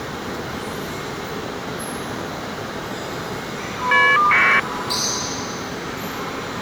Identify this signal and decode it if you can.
Caller ID data burst, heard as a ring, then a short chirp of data, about 1200 baud, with the noise of a subway station.